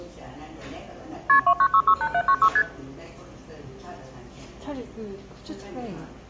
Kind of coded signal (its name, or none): multi-frequency trunk signalling